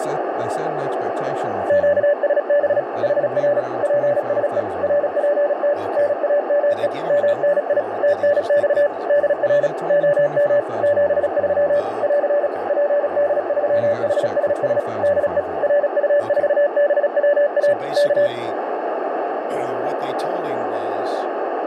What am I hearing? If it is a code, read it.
Morse code, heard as a keyed tone, machine-sent, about 36 wpm, 580 Hz, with heavy radio static, a narrow filter and speech in English. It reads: QSB HR PSE RPT NAME MNI TNX DR OM 73 <AR> PD3HSS DE RU4BWA K